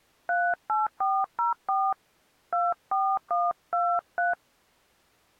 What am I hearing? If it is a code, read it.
DTMF, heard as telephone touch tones, dialled by hand, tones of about 200 ms. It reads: 38404 24123